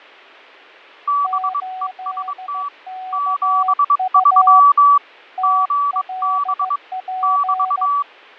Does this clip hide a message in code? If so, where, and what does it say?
Yes: Morse code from 1.0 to 8.1 s, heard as two keyed tones, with fading. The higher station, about 22 wpm, 1150 Hz: BEST 73 GB <BT>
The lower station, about 15 wpm, 750 Hz: 8KU TLP